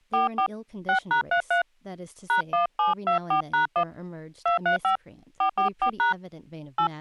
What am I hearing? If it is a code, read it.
DTMF, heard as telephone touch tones, dialled by hand, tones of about 120 ms, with speech in English. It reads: 44 6#33 #1724#1 235 444# 8